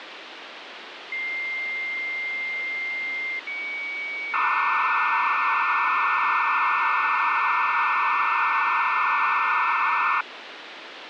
Dial-up modem handshake (low-speed, two carriers), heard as two whistles, then hiss, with phone line noise.